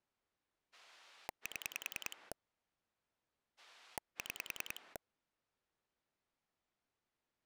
Pulse dialling, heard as a rotary dial, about 10 pulses a second. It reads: 7 6